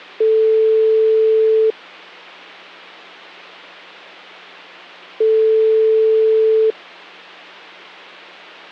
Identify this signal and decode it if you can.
Telephone call progress tone (single-tone plan, as in most of Europe), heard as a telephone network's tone, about 440 Hz, 1.5 s on and 3.5 s off, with hum. Ringback tone.